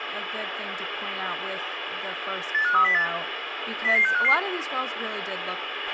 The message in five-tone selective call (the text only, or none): 85308 00655